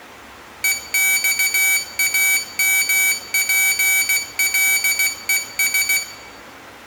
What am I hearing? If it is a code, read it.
Morse code, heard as a high beeper, machine-sent, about 16 wpm, 2300 Hz, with room echo. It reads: EXAMPLES